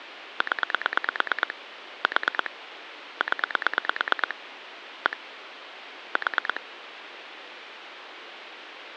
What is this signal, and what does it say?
Pulse dialling, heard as clicks on a phone line, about 9 pulses a second, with phone line noise. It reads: 0 4 0 1 4